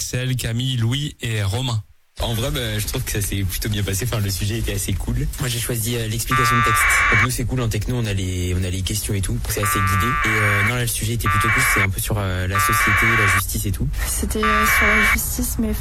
Packet radio (AX.25, as in APRS), 1200 baud, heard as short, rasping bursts.